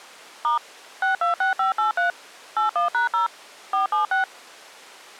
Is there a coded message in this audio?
Yes: DTMF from 0.4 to 4.2 s, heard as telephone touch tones, dialled by machine, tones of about 130 ms. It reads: * 626583 81#0 476